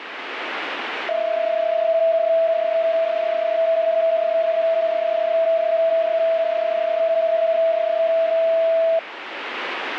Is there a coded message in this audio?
Yes: PSK31 (31.25 baud) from 1.1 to 9.0 s, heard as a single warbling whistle, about 660 Hz, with radio static.